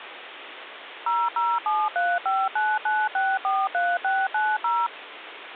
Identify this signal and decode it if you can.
DTMF, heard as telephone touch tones, dialled by machine, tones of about 220 ms, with phone line noise. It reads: 0073599643690